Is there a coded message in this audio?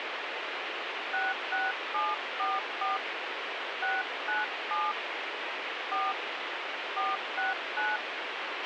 Yes: DTMF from 1.1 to 8.0 s, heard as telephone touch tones, dialled by hand, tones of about 190 ms, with radio hiss and a squelch burst at the end. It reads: 66744 697 4 469